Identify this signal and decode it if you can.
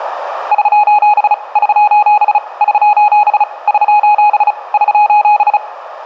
Morse code, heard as a keyed tone, hand-sent with a paddle, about 35 wpm, 840 Hz, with room echo. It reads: <SOS> <SOS> <SOS> <SOS> <SOS>